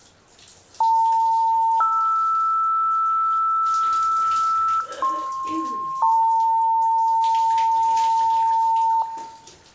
Two-tone page, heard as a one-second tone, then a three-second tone, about 900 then 1320 Hz, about 1060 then 900 Hz, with room echo and the noise of a restroom.